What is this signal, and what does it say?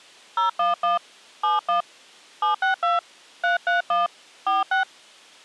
DTMF, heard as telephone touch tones, dialled by hand, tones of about 140 ms. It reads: 011 71 762 331 46